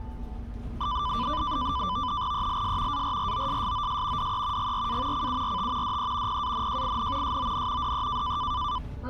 NAVTEX (SITOR-B), 100 baud, 170 Hz shift, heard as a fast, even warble, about 1090 Hz centre, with the noise inside a bus. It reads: ELS ARROSSOS DE GRA CURT DE PANJIN SON DE